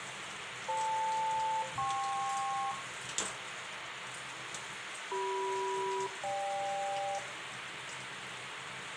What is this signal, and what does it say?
Aircraft SELCAL, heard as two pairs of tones, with radio hiss, room echo and kitchen noise. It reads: FL-KP CM-GK